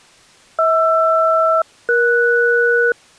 Aircraft SELCAL, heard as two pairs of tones. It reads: HR-ES